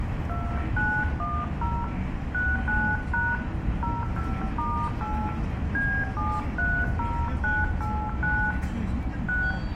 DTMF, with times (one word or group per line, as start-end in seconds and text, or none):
0.3-1.8 2910
2.3-3.3 69#
3.8-5.3 05*8
5.7-8.5 B730989
9.3-9.5 6